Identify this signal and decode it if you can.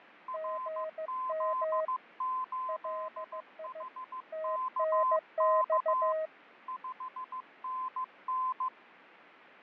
Morse code, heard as two keyed tones, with radio static and fading. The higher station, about 15 wpm, 1030 Hz: RZ8HKK 5NN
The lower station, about 15 wpm, 630 Hz: GM LI TNX